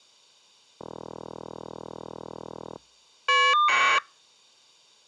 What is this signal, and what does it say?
Caller ID data burst, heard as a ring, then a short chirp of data, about 1200 baud.